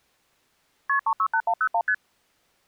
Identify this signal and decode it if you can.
Multi-frequency trunk signalling (R1, as on North American trunks), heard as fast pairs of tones, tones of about 70 ms. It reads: KP 368101 ST